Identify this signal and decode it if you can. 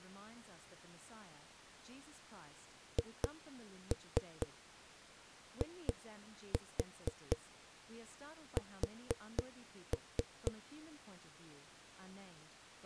Tap code, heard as knocks on a wall, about 4 knocks a second, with speech in English. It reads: HIS